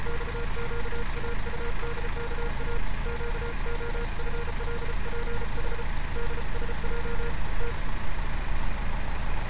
Morse code, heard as a keyed tone, hand-sent with a paddle, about 34 wpm, 470 Hz, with street noise. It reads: XQAUDKA QOFLPH DSJ T